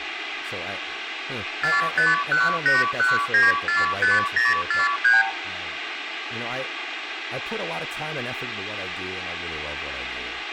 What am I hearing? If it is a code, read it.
Multi-frequency trunk signalling (R2, with the far end's replies), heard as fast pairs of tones, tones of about 170 ms, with phone line noise, room echo and speech in English. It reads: 45181945043